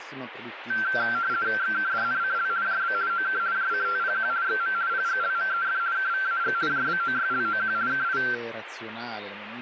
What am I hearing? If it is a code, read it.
RTTY (50 baud, 170 Hz shift), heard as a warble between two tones, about 1460 Hz centre, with radio static and speech in Italian. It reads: XKDNCL JB OK JCTPQ XM PGLMEF KVAG JBOYLOQ KI